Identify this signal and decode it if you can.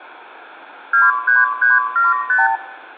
Multi-frequency trunk signalling (R2, with the far end's replies), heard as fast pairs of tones, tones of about 170 ms, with room echo. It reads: 23375